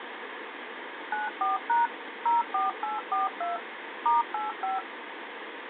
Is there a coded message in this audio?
Yes: DTMF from 1.1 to 4.8 s, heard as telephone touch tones, dialled by machine, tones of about 160 ms, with phone line noise. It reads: 94# 04842 *85